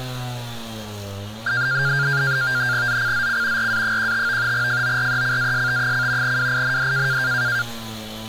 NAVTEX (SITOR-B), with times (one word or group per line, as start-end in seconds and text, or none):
2.9-3.7 ZCZC
3.6-4.5 RA15
4.5-6.4 FORECAST:
6.2-7.2 WIND